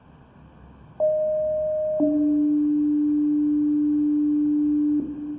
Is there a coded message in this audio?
Yes: two-tone page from 1.0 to 5.0 s, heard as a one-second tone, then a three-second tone, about 620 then 300 Hz, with room echo.